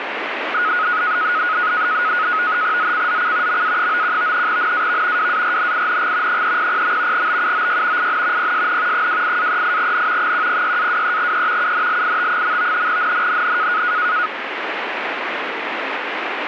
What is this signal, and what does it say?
NAVTEX (SITOR-B), 100 baud, 170 Hz shift, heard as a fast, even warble, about 1360 Hz centre, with radio static. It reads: ZCZC MA91 NAV WARNING 300. BUOY IN PSN 28-38N 106-23E UNLIT. NNNN